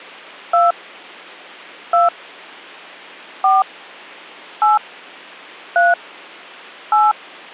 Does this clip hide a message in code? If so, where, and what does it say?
Yes: DTMF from 0.5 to 7.1 s, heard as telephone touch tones, dialled by hand, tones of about 170 ms. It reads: 2 2 4 8 3 8